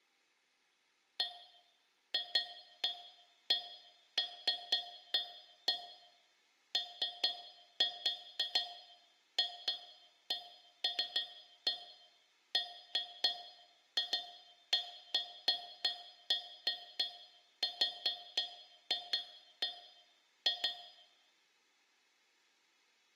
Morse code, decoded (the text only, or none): none